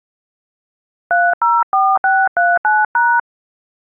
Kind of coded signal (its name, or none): DTMF